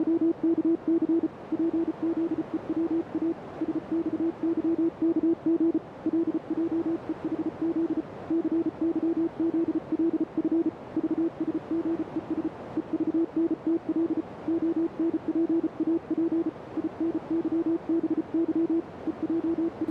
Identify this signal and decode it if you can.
Morse code, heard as a keyed tone, hand-sent with a paddle, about 34 wpm, 330 Hz, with radio static and a narrow filter. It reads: … PZEWA SXYKG LJEHZ CYZLF VSGES EVNTL ONPAP INYBY …